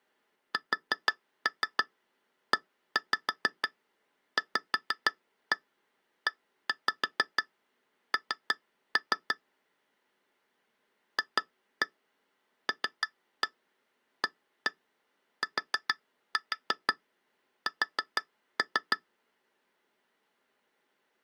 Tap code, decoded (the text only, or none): SEVEN FLATS